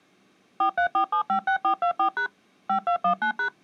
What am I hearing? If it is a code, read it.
DTMF, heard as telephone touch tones, dialled by machine, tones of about 100 ms. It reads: 434756424# 5219#